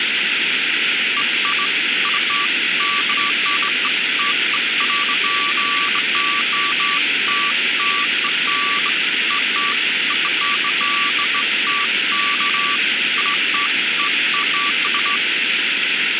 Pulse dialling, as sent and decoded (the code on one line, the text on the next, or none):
none